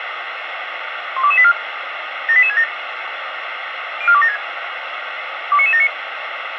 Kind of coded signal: five-tone selective call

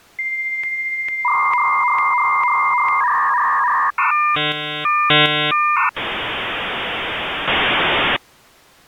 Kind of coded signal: dial-up modem handshake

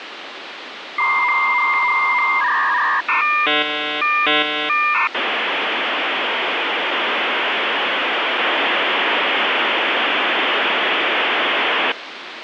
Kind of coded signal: dial-up modem handshake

